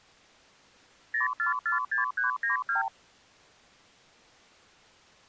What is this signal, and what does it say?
Multi-frequency trunk signalling (R2, with the far end's replies), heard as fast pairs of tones, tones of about 130 ms. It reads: 0446392